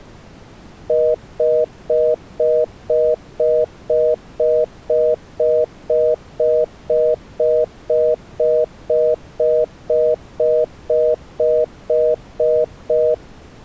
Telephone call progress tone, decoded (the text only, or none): congestion tone